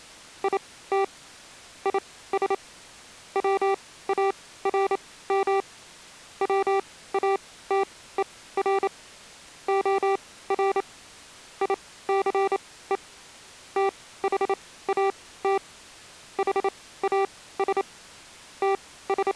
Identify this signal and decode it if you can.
Morse code, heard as electronic beeps, machine-sent, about 28 wpm, spaced as for 17 wpm, 390 Hz. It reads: IT IS WARM WATER OR ICE THAT HAS …